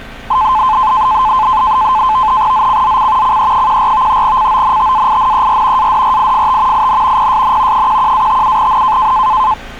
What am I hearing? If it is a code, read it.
NAVTEX (SITOR-B), 100 baud, 170 Hz shift, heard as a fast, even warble, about 950 Hz centre, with street noise. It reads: ZCZC CE14 CONTAINER ADRIFT IN PSN 11-57N